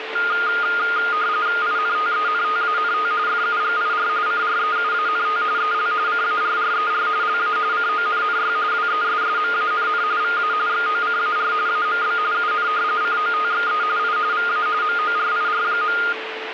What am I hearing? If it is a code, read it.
RTTY (45.45 baud, 170 Hz shift), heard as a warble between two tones, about 1320 Hz centre, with radio static and a steady whistle near 440 Hz. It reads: INTENTANT FUGIR CREUANT EL CARRER LA CONNY WESSMANN VA XOCAR AMB UN COTXE I VA MORIR.